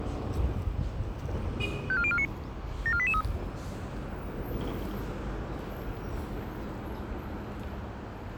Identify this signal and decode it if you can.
Five-tone selective call (ZVEI), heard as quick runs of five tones, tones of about 70 ms, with street noise. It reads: 54049 74883